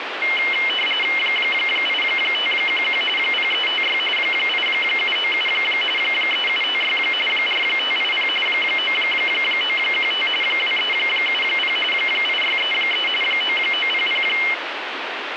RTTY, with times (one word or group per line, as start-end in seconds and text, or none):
1.2-3.0 8511
3.2-4.0 0356
4.2-5.5 8797
6.0-7.0 3756
7.3-8.3 4580
8.5-10.3 9915
10.4-11.8 2370
11.9-13.1 8633
13.2-14.2 9900